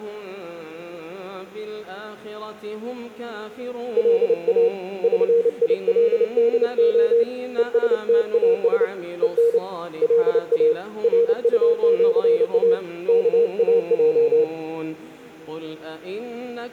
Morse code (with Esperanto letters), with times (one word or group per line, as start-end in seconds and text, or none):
4.0-4.7 LA
5.0-7.2 ŜILDO
7.6-8.8 ESTAS
9.2-9.6 EN
10.0-10.7 LA
11.0-12.7 RUĜA
13.1-14.4 KAJ